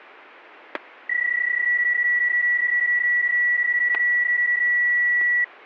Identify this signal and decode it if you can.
PSK31 (31.25 baud), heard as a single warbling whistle, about 1950 Hz, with static crashes.